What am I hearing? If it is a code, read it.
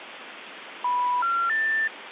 Telephone call progress tone (North American plan), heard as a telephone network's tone, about 980, 1370, 1800 Hz, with phone line noise. Special information tone.